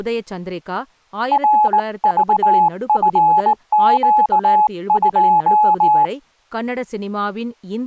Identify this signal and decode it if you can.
Morse code, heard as a keyed tone, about 19 wpm, 850 Hz, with speech in Tamil. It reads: RVFQ2